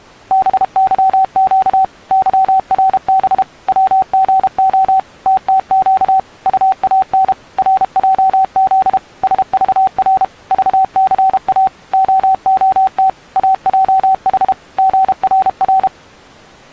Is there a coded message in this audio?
Yes: Morse code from 0.3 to 15.9 s, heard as a keyed tone, machine-sent, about 32 wpm, 760 Hz. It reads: BYQ YRB WGO TTQ UAN RJZ SVR VCA OOT AJH GRR